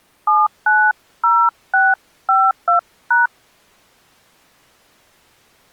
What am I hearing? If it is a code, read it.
DTMF, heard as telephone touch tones, dialled by hand, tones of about 200 ms. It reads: 790652#